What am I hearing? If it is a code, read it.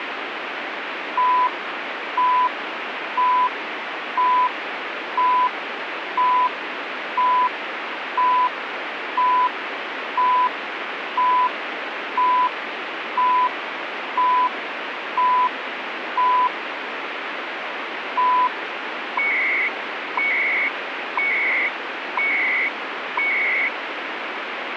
Radio time signal (CHU, Canada), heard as beeps and data bursts, one a second, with radio static.